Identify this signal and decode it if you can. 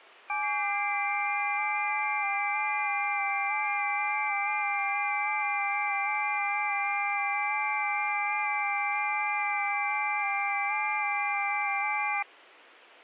FT8 (several signals at once), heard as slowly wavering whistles, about 6.25 baud.